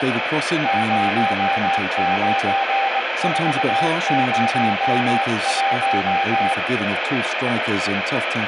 Morse code, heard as a keyed tone, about 21 wpm, 790 Hz, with radio static, room echo and speech in English. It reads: 09401